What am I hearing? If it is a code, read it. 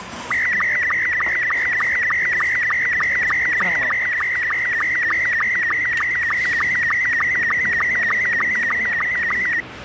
SSTV (slow-scan television), Robot 72, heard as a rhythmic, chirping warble, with radio static and the noise of a restaurant.